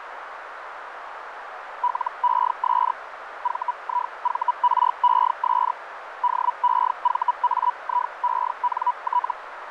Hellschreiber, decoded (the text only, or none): LES VIVRES DEVAIENT